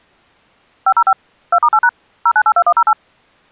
DTMF, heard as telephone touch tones, dialled by machine, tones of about 60 ms. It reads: 505 2*8# 0982108